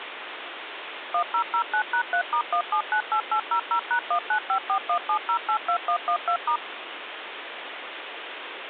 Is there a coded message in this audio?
Yes: DTMF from 1.1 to 6.6 s, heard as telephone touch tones, dialled by machine, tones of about 80 ms, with phone line noise. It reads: 1009#3*1798800#195417082112*